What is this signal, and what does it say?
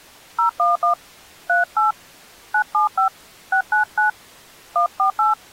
DTMF, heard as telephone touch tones, dialled by hand, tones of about 120 ms. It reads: 011 38 975 699 148